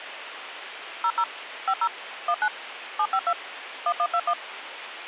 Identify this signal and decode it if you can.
DTMF, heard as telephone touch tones, dialled by machine, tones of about 60 ms, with phone line noise. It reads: 00 50 19 752 1121